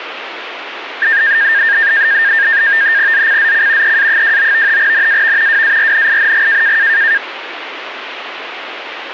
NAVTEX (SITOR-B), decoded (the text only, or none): ZCZC EA29 NAV WARNING